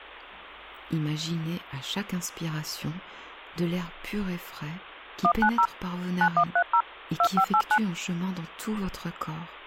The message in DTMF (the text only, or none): 190 9130 2589